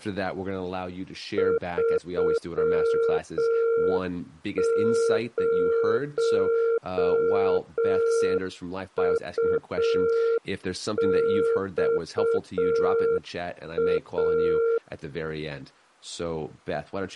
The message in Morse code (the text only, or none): 30UXA